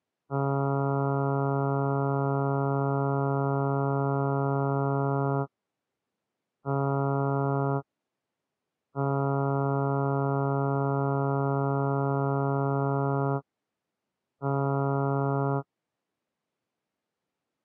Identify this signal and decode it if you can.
Ship horn signal, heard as a ship's horn, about 140 Hz. 1 long, 1 short, 1 long, 1 short. At sea: I agree to be overtaken.